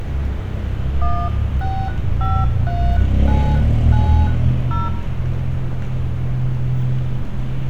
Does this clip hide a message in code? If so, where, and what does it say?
Yes: DTMF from 1.0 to 4.9 s, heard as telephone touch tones, dialled by hand, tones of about 260 ms, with room echo and street noise. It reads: 1653990